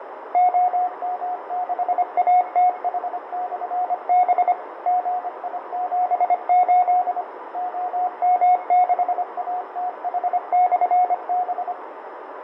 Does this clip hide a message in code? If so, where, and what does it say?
Yes: Morse code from 0.3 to 11.8 s, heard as a keyed tone, machine-sent, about 25 wpm, 730 Hz, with radio static, fading, a narrow filter and room echo. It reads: OM6ATH/B GI78 OM6ATH/B